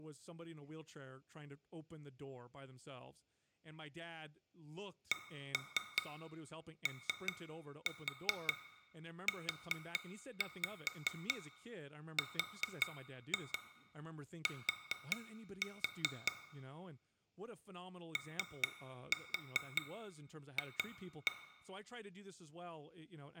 Tap code, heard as taps on glass, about 5 knocks a second, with room echo and speech in English. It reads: COURT OF